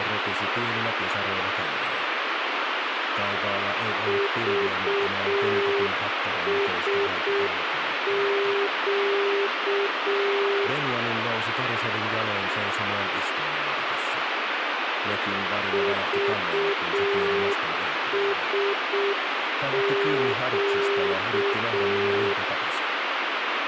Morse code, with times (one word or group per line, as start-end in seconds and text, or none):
4.1-10.7 VSQ
15.7-22.3 VSQ